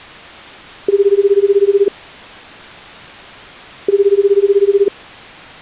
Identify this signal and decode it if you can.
Telephone call progress tone (Japanese plan), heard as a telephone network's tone, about 380, 400, 420 Hz, 1 s on and 2 s off. Ringback tone.